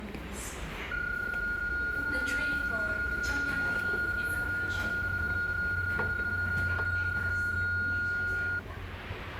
PSK31 (31.25 baud), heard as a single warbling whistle, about 1430 Hz, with the noise of a subway station.